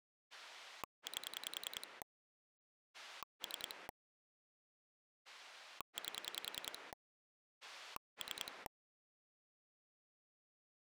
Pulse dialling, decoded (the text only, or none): 8 3 8 3